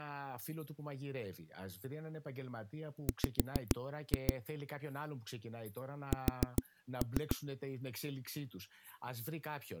Tap code, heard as knocks on a wall, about 7 knocks a second, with speech in Greek. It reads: W S